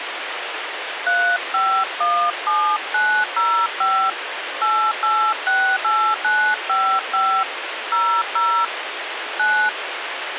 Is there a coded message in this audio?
Yes: DTMF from 1.1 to 9.7 s, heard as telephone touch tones, dialled by hand, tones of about 300 ms, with phone line noise. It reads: 3517905 8868955 00 9